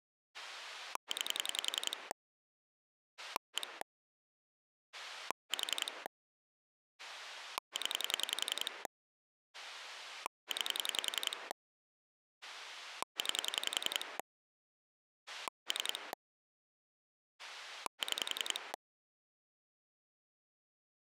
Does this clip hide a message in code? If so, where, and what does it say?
Yes: pulse dialling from 0.3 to 18.8 s, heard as a rotary dial, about 10 pulses a second. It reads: 9 1 4 0 9 9 3 6